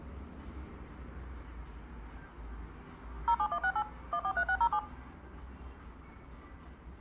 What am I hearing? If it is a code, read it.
DTMF, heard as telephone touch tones, dialled by machine, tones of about 70 ms, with the noise of a cafe. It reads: 07168 143607